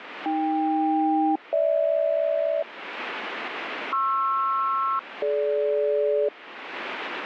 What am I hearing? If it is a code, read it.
Aircraft SELCAL, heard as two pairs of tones, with radio static. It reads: AK-GH PR-DG